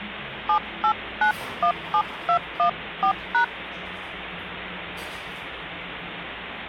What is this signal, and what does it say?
DTMF, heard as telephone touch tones, dialled by hand, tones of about 80 ms, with phone line noise and the noise of a cafe. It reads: 78917214#